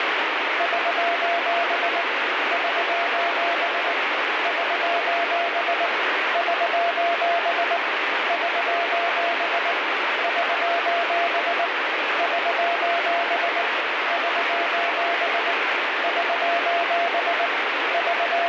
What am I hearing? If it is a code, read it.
Morse code, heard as a keyed tone, hand-sent with a paddle, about 19 wpm, 690 Hz, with heavy radio static. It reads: <SOS> <SOS> <SOS> <SOS> <SOS> <SOS> <SOS> <SOS> <SOS> …